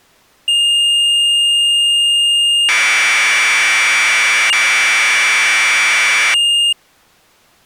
Commodore tape loading (standard loader), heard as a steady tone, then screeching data.